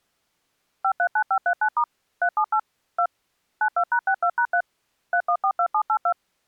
DTMF, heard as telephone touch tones, dialled by machine, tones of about 80 ms. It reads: 539539* 378 2 92#62#3 3142782